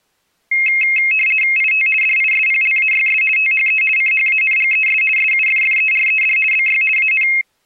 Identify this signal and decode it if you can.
RTTY (50 baud, 450 Hz shift), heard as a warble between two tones, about 2350 Hz centre. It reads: IT DISPLAYS THE CHANGES SUFFERED BY AN